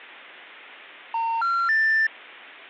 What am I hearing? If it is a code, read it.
Telephone call progress tone (North American plan), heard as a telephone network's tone, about 910, 1370, 1800 Hz. Special information tone.